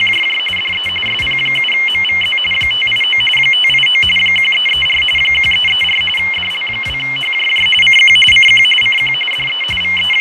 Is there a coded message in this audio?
Yes: RTTY (45.45 baud, 850 Hz shift) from 0.0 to 10.2 s, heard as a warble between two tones, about 2550 Hz centre, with radio static and fading. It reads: … DE SP7MVZ 589 589 1334 1334 DL2HJJ CQ CQ CQ DE …